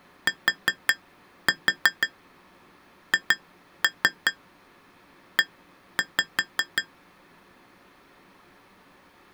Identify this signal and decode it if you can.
Tap code, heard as taps on glass, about 5 knocks a second. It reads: THE